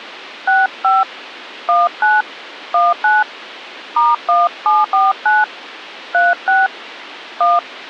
DTMF, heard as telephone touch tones, dialled by hand, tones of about 190 ms. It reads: 65 19 19 *1749 36 1